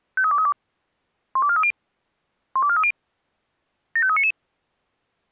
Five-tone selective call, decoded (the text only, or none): 53232 12430 12430 75399